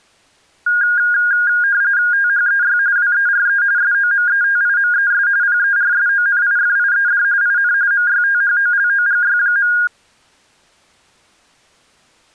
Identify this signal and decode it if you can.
RTTY (45.45 baud, 170 Hz shift), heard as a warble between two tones, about 1550 Hz centre. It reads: THEY WERE SOMETIMES PERSONIFIED IN MYTHOLOGY.